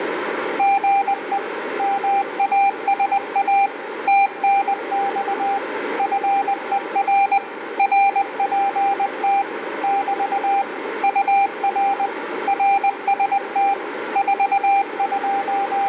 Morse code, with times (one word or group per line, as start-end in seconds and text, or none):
0.6-1.4 GE
1.8-3.7 MASA
4.1-5.6 TNX
6.0-7.4 FER
7.8-9.4 RPT
9.8-10.6 <BT>
11.0-12.1 UR
12.5-13.7 RST
14.2-15.9 …